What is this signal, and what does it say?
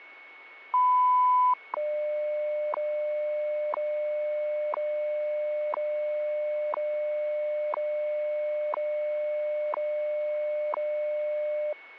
Radio time signal (WWV, Colorado), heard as ticks, one a second, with a steady whistle near 2210 Hz.